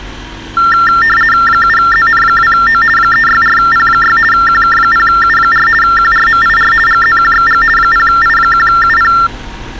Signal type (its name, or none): RTTY